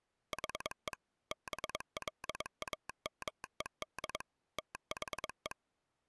Morse code, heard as a telegraph sounder, machine-sent, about 22 wpm. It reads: HE BLAMED THE